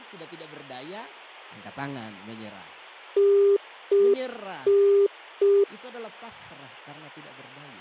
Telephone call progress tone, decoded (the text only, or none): congestion tone